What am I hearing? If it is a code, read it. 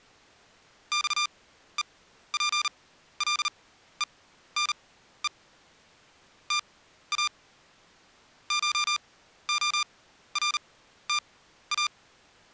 Morse code (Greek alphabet), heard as electronic beeps, machine-sent, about 39 wpm, spaced as for 14 wpm, 1200 Hz. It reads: ΞΕΠΛΕΝΕ ΤΑ ΧΟΡΤΑ